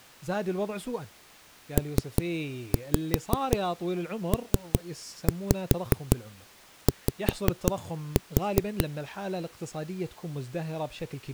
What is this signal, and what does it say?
Tap code, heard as knocks on a wall, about 5 knocks a second, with speech in Arabic. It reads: PPY